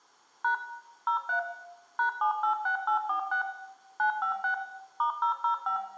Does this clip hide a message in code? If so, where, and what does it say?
Yes: DTMF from 0.4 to 5.8 s, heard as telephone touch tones, dialled by machine, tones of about 100 ms, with room echo. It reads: # 03 #786846 956 *005